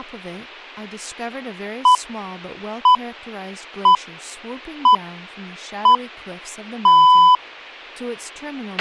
Radio time signal (six pips, as the Greenwich Time Signal), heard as pips, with a squelch burst at the end and speech in English.